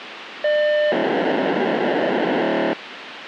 POCSAG pager data (1200 baud), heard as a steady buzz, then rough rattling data, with radio hiss.